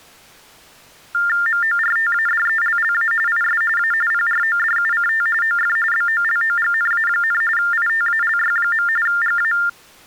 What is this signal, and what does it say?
TTY/TDD text telephone tones (45.45 baud Baudot), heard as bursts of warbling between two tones, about 400 Hz shift, 1600 Hz centre. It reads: MORTADELLA IS A PRODUCT OF BOLOGNA, ITALY. GA